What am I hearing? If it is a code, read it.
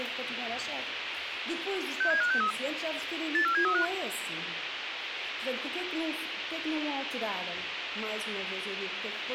Five-tone selective call (CCIR), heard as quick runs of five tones, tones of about 100 ms, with radio hiss. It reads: 67563 84735